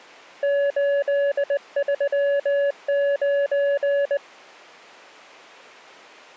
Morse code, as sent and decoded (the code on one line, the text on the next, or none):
---.. ...-- ----.
839